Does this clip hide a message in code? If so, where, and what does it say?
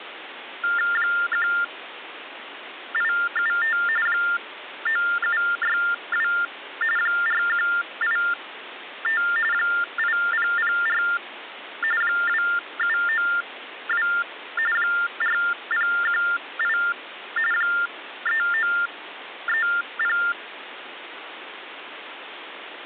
Yes: TTY/TDD text telephone tones (45.45 baud Baudot) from 0.6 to 20.3 s, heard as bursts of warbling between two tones, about 400 Hz shift, 1600 Hz centre, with phone line noise. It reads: 1875 9762 4185 8004 2792 4018 3930